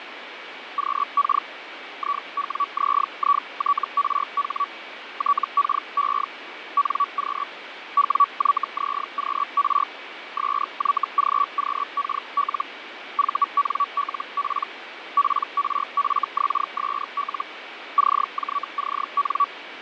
Hellschreiber (Feld-Hell, 122.5 baud), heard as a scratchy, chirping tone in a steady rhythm, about 1140 Hz, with radio static and fading. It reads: QK IWZITRH TKE NQ WYZQR SYGQKL VNLP PRFXSL CJCN